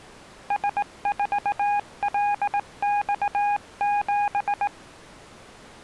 Morse code, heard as a keyed tone, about 18 wpm, 820 Hz. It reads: S4LX7